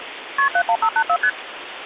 Multi-frequency trunk signalling (R1, as on North American trunks), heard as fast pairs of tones, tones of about 70 ms, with phone line noise. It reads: KP 71584 ST